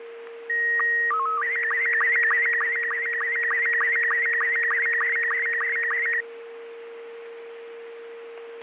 SSTV (slow-scan television), Robot 72, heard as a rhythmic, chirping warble, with radio static and a steady whistle near 460 Hz.